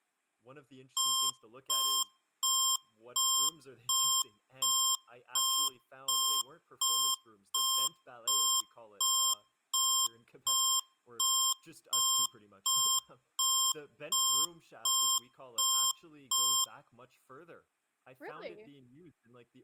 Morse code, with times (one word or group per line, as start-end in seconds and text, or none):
none